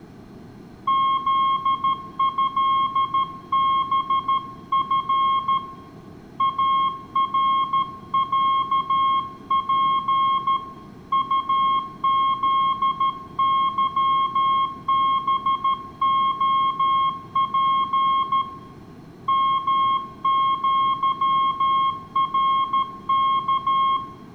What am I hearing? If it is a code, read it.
Morse code (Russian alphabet), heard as a keyed tone, hand-sent with a paddle, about 13 wpm, 1080 Hz, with room echo. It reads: ЗЭБФ АРЯП УЗЫБОП МЪРК